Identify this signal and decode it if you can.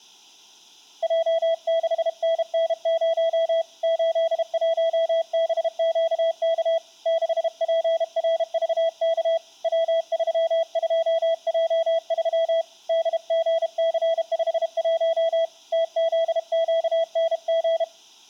Morse code, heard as a keyed tone, hand-sent with a paddle, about 32 wpm, 660 Hz. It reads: J6NN0 81BQK 6PRVK W32J3 DGC51 TZQNG